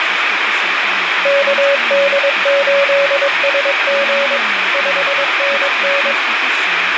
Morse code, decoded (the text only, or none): KD8SG 5NN